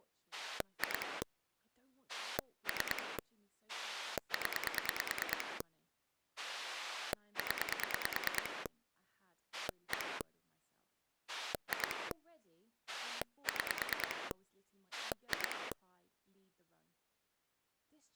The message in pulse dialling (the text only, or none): 2 3 0 0 1 2 6 2